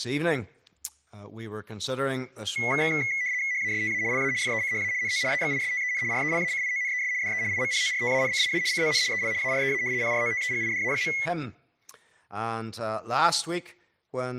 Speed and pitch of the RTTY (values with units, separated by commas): 75 baud, 170 Hz shift, 2100 Hz centre